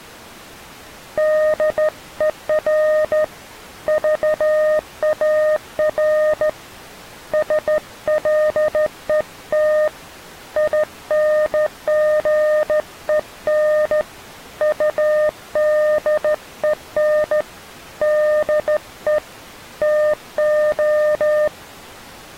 Morse code, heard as a keyed tone, hand-sent with a straight key, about 14 wpm, 610 Hz. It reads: DER VAR SLET INGEN UDEN DE TO